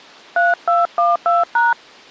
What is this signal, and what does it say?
DTMF, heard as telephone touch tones, dialled by hand, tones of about 180 ms. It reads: 3212#